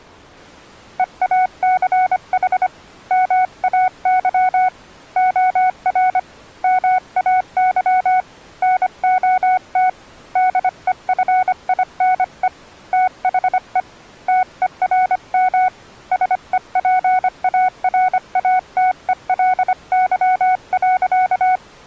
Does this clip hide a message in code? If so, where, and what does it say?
Yes: Morse code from 0.9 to 21.6 s, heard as a keyed tone, hand-sent with a paddle, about 25 wpm, 740 Hz. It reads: EACH MAY OR MAY NOT DEFINE THE TERM SEPARATELY.